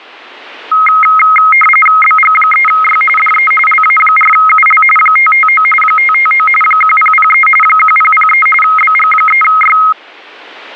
RTTY (45.45 baud, 850 Hz shift), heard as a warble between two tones, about 1700 Hz centre. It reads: BG3Y DE LA4UL 559 559 1003 1003 BG3Y